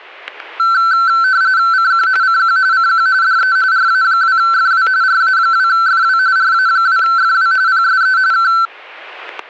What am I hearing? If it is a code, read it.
RTTY (45.45 baud, 170 Hz shift), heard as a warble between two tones, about 1440 Hz centre, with static crashes. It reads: CQ CQ CQ DE RA2FW RA2FW RA2FW PSE K